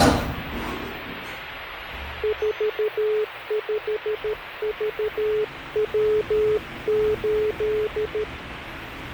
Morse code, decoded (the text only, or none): 45VW8